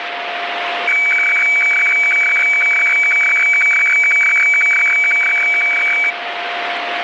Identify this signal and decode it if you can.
Weather fax (radiofax), 120 lines a minute, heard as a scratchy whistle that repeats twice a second, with radio static and a steady whistle near 700 Hz.